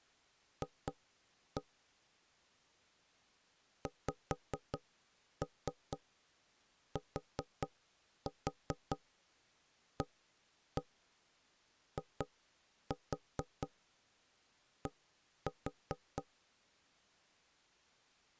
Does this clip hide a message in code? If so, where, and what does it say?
Yes: tap code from 0.6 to 16.3 s, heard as knocks on wood, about 4 knocks a second. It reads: F XTAID